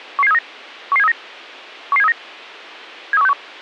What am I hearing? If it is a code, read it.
Five-tone selective call (EEA), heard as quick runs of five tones, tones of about 40 ms. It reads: 11739 11739 11739 73161